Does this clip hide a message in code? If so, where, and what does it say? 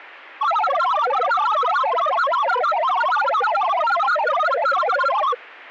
Yes: multi-tone FSK (Olivia or MFSK type), about 1000 Hz wide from 0.4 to 5.4 s, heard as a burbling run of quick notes, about 62.5 baud.